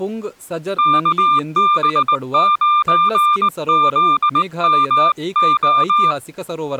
Morse code, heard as a keyed tone, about 19 wpm, 1200 Hz, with speech in Kannada. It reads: KB9ZMO